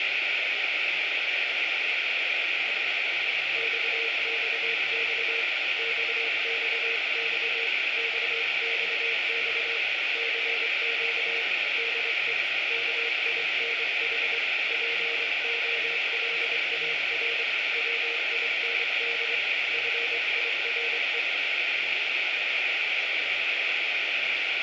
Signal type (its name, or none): Morse code